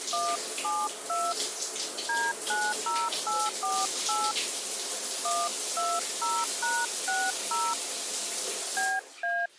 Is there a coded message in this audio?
Yes: DTMF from 0.1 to 9.5 s, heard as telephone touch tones, dialled by hand, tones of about 230 ms, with the noise of a restroom. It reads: 172 D90848 120#60 BA